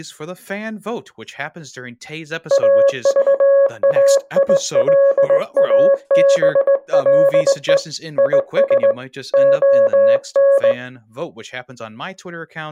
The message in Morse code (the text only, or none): AVAILABLE IS ON